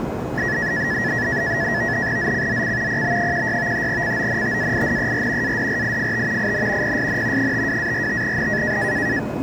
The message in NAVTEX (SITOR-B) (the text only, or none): ZCZC PB16 CONTAINER ADRIFT IN PSN 52-45N